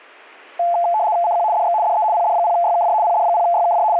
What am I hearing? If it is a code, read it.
RTTY (75 baud, 170 Hz shift), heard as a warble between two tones, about 780 Hz centre. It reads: CQ DX DE PD0YKJ PD0YKJ …